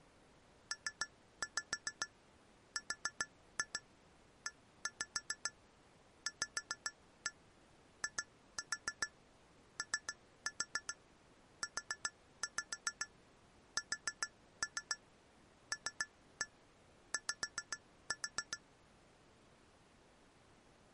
Tap code, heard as taps on glass, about 7 knocks a second. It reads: PREVIOUSLY